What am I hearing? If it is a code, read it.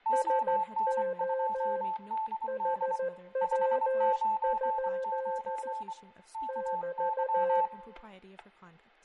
Morse code, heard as two keyed tones, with fading, static crashes, room echo and speech in English. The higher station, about 24 wpm, 880 Hz: ON2DD 599 KY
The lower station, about 14 wpm, 530 Hz: SO HW? <BT>